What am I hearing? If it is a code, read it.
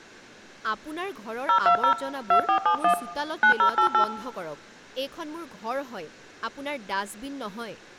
DTMF, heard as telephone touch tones, dialled by hand, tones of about 90 ms, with speech in Assamese. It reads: 020 2471 9088